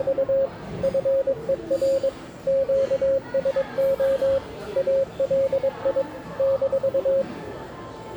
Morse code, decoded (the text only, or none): … FER QSO ALI -